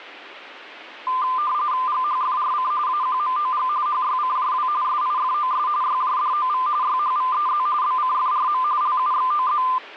RTTY (45.45 baud, 170 Hz shift), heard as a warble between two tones, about 1110 Hz centre. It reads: GHFRC AQMOG HYCJW SIFOS YJDOV YHVEZ BCFRM LUXOZ